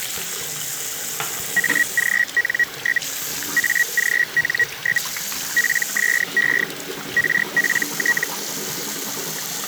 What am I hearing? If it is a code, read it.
Hellschreiber (Feld-Hell, 122.5 baud), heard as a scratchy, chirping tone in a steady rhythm, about 1900 Hz, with the noise of a restroom. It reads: AGN? AGN? PSE RPT